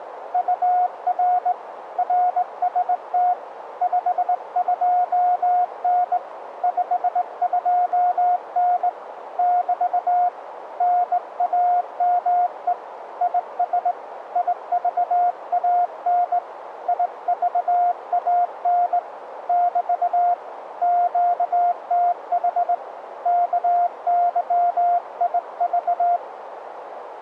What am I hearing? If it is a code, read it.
Morse code, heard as a keyed tone, hand-sent with a straight key, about 19 wpm, 710 Hz, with radio static and a narrow filter. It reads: UR RST 52N 52N <BT> NAME IS IVAN IVAN <BT> QTH KYIV